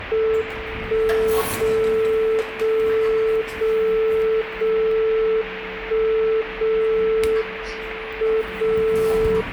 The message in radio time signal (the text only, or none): 1 0 0 0 0 1 0 M 0